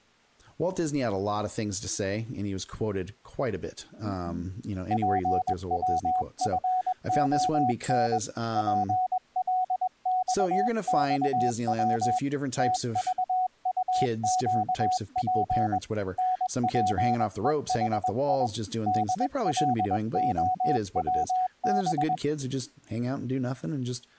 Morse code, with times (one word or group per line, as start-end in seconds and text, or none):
4.9-8.2 PWFON
8.6-12.2 PLXXW
12.6-15.8 TVUQP
16.2-18.5 NPEHI
18.9-22.1 DLOWB